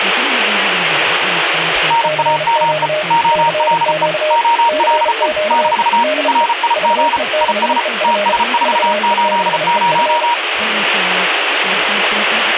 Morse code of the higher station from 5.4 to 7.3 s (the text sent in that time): - RIG